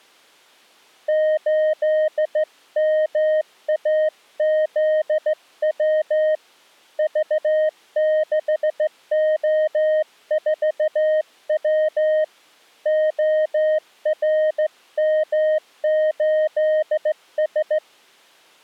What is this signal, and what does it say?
Morse code, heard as a keyed tone, hand-sent with a straight key, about 15 wpm, 620 Hz. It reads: 8MAZW V6O4W ORM8S